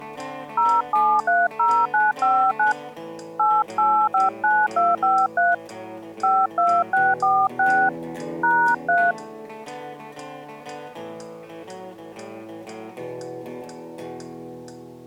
DTMF, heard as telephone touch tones, dialled by hand, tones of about 220 ms. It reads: 0730959 8859253 52646 #3